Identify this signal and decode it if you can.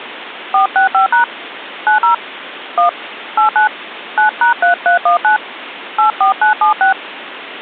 DTMF, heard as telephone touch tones, dialled by hand, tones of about 120 ms, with phone line noise. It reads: 465# 90 1 89 9#3319 84976